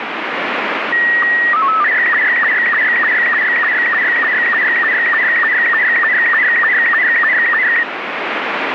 SSTV (slow-scan television), Robot 72, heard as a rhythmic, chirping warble, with radio static.